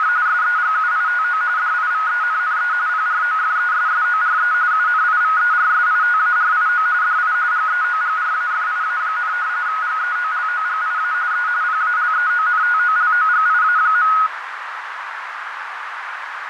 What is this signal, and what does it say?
RTTY (45.45 baud, 170 Hz shift), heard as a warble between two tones, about 1360 Hz centre, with radio static and a narrow filter. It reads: … SEGUITO DIVENNE PROFESSORE UNIVERSITARIO DI GEOGRAFIA, GEOLOGIA E PALEONTOLOGIA.